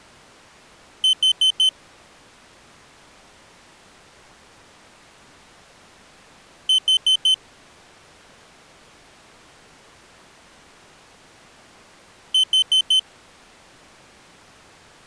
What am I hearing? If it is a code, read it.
Alarm pattern, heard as an alarm's beeps, played three times, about 3050 Hz. Temporal four. Carbon monoxide.